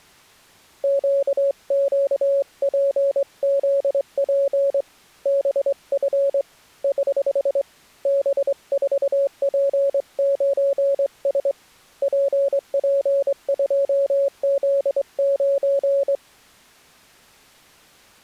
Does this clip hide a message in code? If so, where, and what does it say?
Yes: Morse code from 0.8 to 16.2 s, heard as a keyed tone, hand-sent with a straight key, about 23 wpm, 560 Hz. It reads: QQPZP BF <HH> B4P9S PP2Z9